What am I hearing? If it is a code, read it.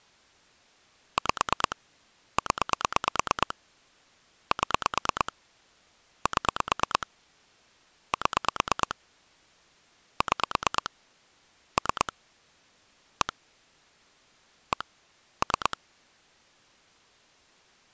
Pulse dialling, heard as clicks on a phone line, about 9 pulses a second. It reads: 5 0 7 7 7 6 3 1 1 3